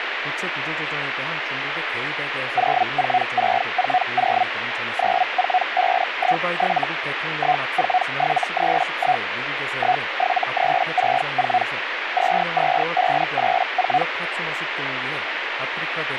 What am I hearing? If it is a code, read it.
Hellschreiber (Feld-Hell, 122.5 baud), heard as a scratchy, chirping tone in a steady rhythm, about 740 Hz, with radio static. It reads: 04640 94517 14731 17364 22584